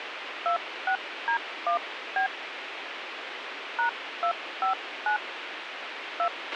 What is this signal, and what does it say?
DTMF, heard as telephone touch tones, dialled by hand, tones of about 100 ms, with radio hiss and a squelch burst at the end. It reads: 26D1B #259 2